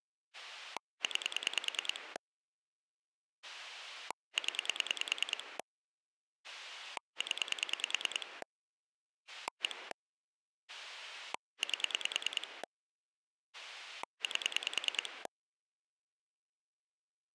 Pulse dialling, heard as a rotary dial, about 9 pulses a second. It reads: 9 0 0 1 8 8